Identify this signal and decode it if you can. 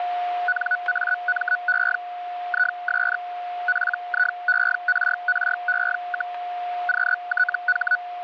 Hellschreiber (Feld-Hell, 122.5 baud), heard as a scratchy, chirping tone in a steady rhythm, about 1480 Hz, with a steady whistle near 710 Hz. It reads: NAME IS PIERRE, QTH